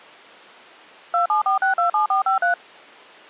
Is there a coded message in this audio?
Yes: DTMF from 1.1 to 2.5 s, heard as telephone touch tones, dialled by machine, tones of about 120 ms. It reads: 274627453